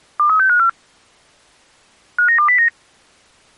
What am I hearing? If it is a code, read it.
Five-tone selective call (CCIR), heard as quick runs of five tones, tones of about 100 ms. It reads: 23654 59209